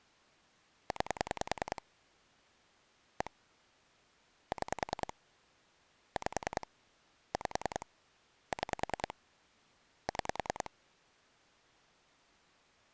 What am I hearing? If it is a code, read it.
Pulse dialling, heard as clicks on a phone line, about 10 pulses a second. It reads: 9 1 6 5 5 6 6